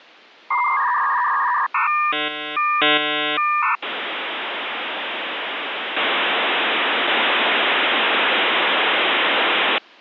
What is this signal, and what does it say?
Dial-up modem handshake (V.34 or later), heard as a whistle, warbles, then hiss.